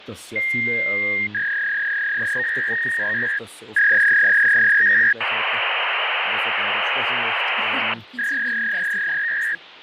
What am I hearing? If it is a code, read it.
Fax machine handshake, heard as a long tone, a warble and hiss, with phone line noise and speech in German.